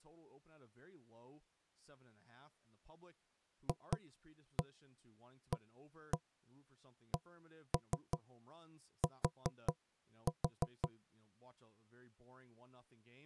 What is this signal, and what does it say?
Tap code, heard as knocks on wood, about 5 knocks a second, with speech in English. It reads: FACT